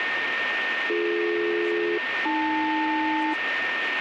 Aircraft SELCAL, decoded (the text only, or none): BD-AL